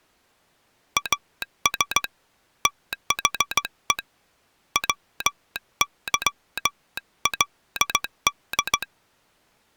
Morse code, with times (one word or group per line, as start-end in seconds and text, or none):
1.0-2.0 AS
2.7-4.0 THE
4.8-8.8 WYLD